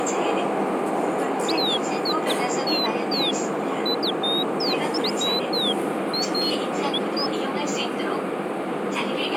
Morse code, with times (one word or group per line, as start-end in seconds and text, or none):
none